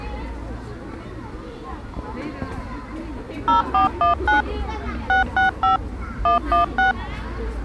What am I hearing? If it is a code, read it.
DTMF, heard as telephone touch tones, dialled by machine, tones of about 130 ms, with the noise of a park. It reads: 0419 665 116